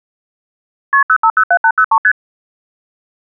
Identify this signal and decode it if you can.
Multi-frequency trunk signalling (R1, as on North American trunks), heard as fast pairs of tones, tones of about 70 ms. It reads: KP 0507803 ST